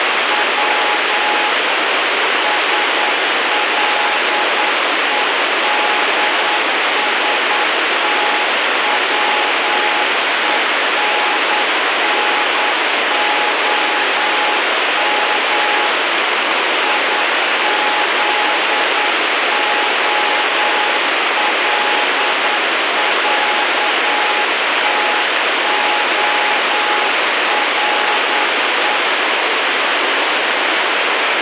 Morse code (Russian alphabet), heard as a keyed tone, machine-sent, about 9 wpm, 840 Hz, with heavy radio static. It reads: В СЛЕДСТВЕННОМ ИЗОЛЯТОРЕ